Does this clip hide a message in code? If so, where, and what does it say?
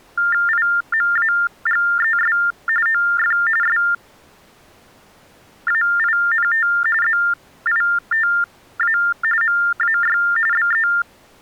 Yes: TTY/TDD text telephone tones (45.45 baud Baudot) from 0.2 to 11.0 s, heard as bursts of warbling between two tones, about 400 Hz shift, 1600 Hz centre. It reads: IMAGES OF SAINT ZITA MAY BE